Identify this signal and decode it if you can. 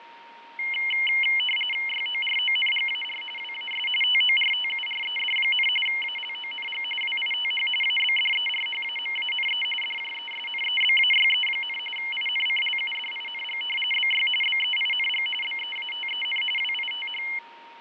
RTTY (45.45 baud, 850 Hz shift), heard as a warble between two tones, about 2550 Hz centre, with radio static, fading and a steady whistle near 930 Hz. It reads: YORONGAR WAS TORTURED, ALONG WITH ABDERHAMANE DJESNEBAYE, INCLUDING BY BEING BEATEN WITH